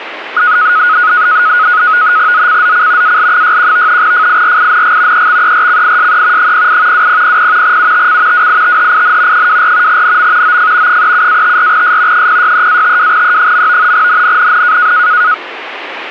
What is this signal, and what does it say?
NAVTEX (SITOR-B), 100 baud, 170 Hz shift, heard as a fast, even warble, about 1360 Hz centre, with radio static. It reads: ZCZC AL61 FIRING EXERCISE 08 2000 UTC WITHIN 24 NM OF 37-54S 063-52E. NNNN